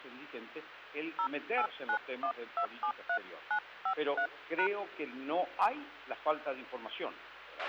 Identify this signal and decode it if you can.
DTMF, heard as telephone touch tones, dialled by hand, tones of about 80 ms, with a squelch burst at the end. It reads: 0891273953#